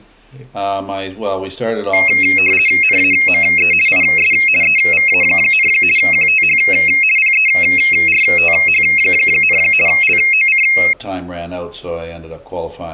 RTTY (50 baud, 450 Hz shift), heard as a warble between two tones, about 2350 Hz centre. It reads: NAME IS EVA, QTH PERTH, LOC